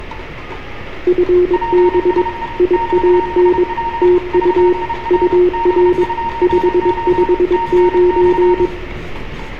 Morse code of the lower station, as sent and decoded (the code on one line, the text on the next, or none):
..-. -... / .. .- -. / - ..- / ..- .-. / ..... ..... ----.
FB IAN TU UR 559